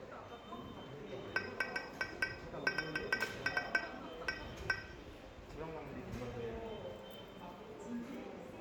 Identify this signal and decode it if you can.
Irregular taps on glass, with room echo and the noise of a subway station. There is no code.